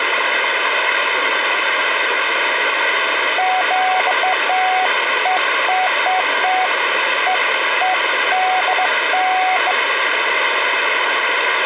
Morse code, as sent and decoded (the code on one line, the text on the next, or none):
none